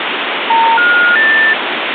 Telephone call progress tone (North American plan), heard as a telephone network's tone, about 910, 1430, 1800 Hz, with phone line noise. Special information tone.